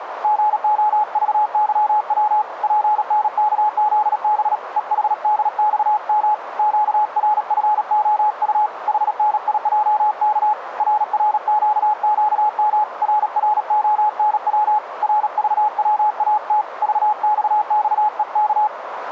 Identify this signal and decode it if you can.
Morse code, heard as a keyed tone, hand-sent with a paddle, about 37 wpm, 850 Hz, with radio static and a narrow filter. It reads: GOVYW PNKZB EHDXM QRFOU HNIJK RRQQM RRONW RVWAT VXXEK